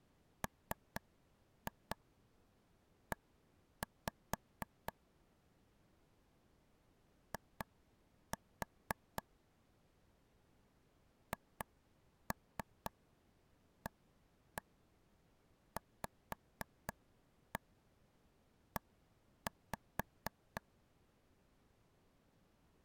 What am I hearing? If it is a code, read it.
Tap code, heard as taps on a table, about 4 knocks a second. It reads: ME I HAVE